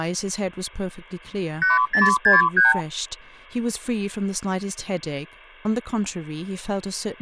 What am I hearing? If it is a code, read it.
Multi-frequency trunk signalling (R2, with the far end's replies), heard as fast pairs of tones, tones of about 160 ms, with speech in English. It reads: 8063